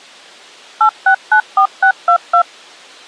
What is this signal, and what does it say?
DTMF, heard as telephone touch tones, dialled by machine, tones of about 90 ms. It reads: 8694622